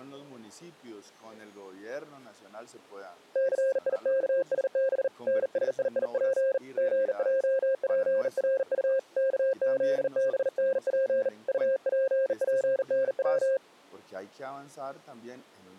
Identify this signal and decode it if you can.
Morse code, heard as a keyed tone, hand-sent with a bug key, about 39 wpm, 530 Hz. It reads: CIKSB NSIIP GJPRU KZBNP UPPNW